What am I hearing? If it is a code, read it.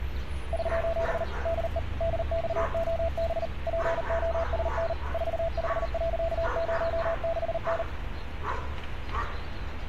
Morse code, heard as a keyed tone, machine-sent, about 39 wpm, 660 Hz, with street noise. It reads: <SOS> DE DXOB POSN 45.06N